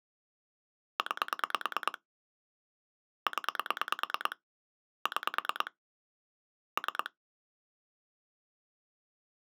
Pulse dialling, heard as clicks on a phone line, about 9 pulses a second. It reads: 9 0 6 3